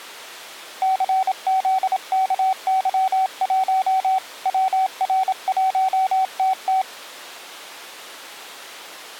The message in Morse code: CZKY1 WR1TT

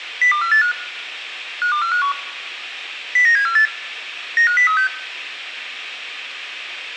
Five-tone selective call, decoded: 02485 52451 09748 95036

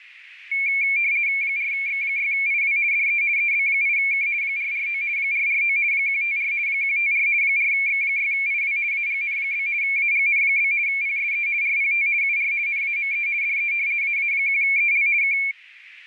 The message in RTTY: 4X6IW DE EB8K 449 449 154 154 4X6IW AGN? AGN? PSE RPT UR NAME DE AA1EL K

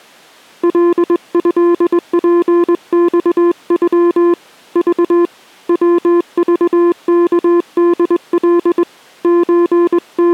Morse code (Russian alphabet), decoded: ЛЭПЬЮ Ж ВЖКДЛ …

